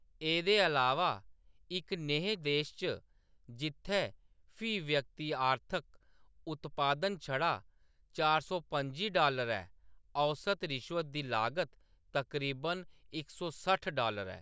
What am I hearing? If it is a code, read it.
Speech in Dogri. There is no code.